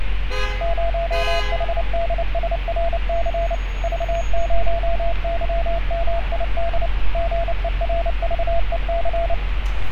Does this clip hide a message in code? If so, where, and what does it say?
Yes: Morse code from 0.6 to 9.4 s, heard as a keyed tone, machine-sent, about 29 wpm, 680 Hz, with radio static and street noise. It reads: 0HDSRC V0YMID GERVEC